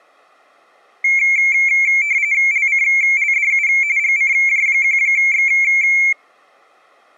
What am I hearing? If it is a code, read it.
RTTY (45.45 baud, 170 Hz shift), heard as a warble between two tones, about 2250 Hz centre. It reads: LCLDU GCJ1X